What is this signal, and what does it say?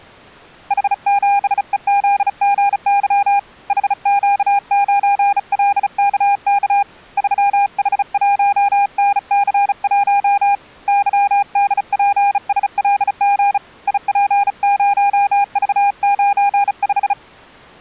Morse code, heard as a keyed tone, hand-sent with a bug key, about 35 wpm, 810 Hz. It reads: H7EZGY HQ9LKK 3H1NC1 YDPSLG IP0V95